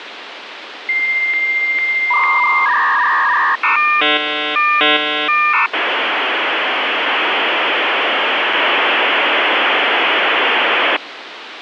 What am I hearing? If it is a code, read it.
Dial-up modem handshake (V.34 or later), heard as a whistle, warbles, then hiss, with phone line noise.